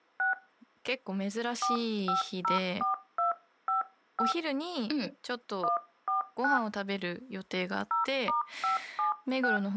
DTMF, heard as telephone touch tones, dialled by hand, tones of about 130 ms, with speech in Japanese. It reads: 6 4504255 149 0*576